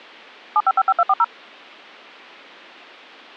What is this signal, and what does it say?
DTMF, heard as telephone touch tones, dialled by machine, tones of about 50 ms. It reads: 7555240